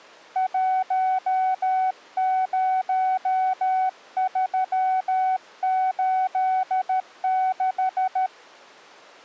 Morse code, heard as a keyed tone, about 13 wpm, 750 Hz. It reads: 10386